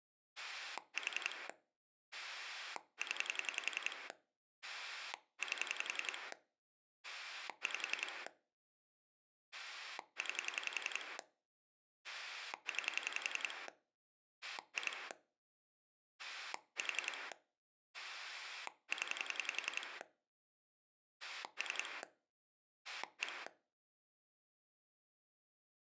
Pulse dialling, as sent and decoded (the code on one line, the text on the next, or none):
4 / 10 / 8 / 5 / 9 / 9 / 2 / 4 / 10 / 3 / 1
4 0 8 5 9 9 2 4 0 3 1